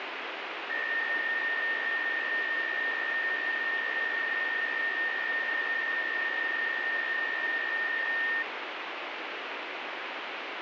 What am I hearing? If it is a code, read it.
PSK63 (62.5 baud), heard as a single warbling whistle, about 1850 Hz, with radio static.